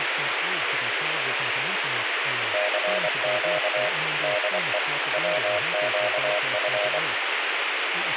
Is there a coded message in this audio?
Yes: Morse code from 2.5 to 7.0 s, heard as a keyed tone, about 24 wpm, 620 Hz, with radio hiss and speech in English. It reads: CQ DE WQF